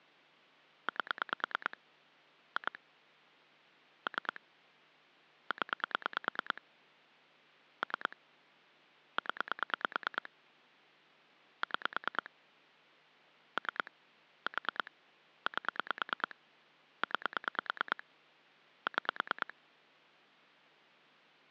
Pulse dialling, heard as clicks on a phone line, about 9 pulses a second. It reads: 8 2 3 0 3 0 6 3 4 8 9 6